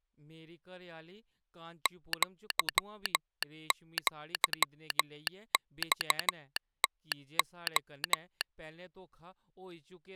Morse code (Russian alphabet), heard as a telegraph sounder, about 13 wpm, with speech in Dogri. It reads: ЪЪЬТО